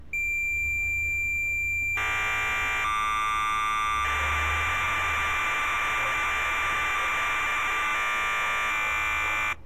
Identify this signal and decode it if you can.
Cassette data (Kansas City type), 1200 baud, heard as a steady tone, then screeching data, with street noise.